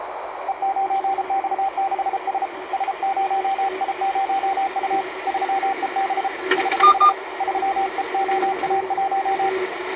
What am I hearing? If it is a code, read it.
Morse code, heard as a keyed tone, hand-sent with a paddle, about 33 wpm, 780 Hz, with radio static, a narrow filter and the noise inside a car. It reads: E9X6S S0I0U 3EB <HH> 3EOA1